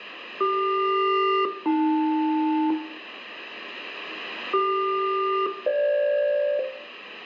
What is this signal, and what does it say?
Aircraft SELCAL, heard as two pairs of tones, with room echo. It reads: CQ-AL CQ-FG